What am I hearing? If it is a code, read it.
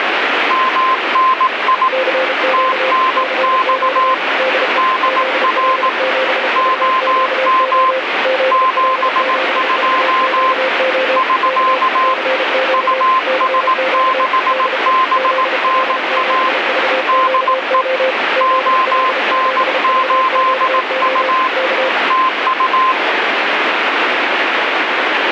Morse code, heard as two keyed tones, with heavy radio static. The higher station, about 18 wpm, 1040 Hz: MNI TNX DR OM 72 <SK> US6BNA DE ON8U TU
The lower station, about 33 wpm, 520 Hz: CQ CQ DE ZL7VQO ZL7VQO K CQ CQ DE ZL7VQO ZL7VQO K